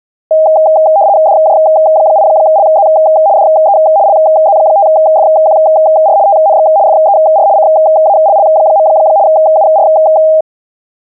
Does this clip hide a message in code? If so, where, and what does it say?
Yes: RTTY (75 baud, 170 Hz shift) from 0.3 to 10.4 s, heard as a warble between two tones, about 720 Hz centre. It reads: DJ8LZ DE LZ5FQR TNX FER CALL. UR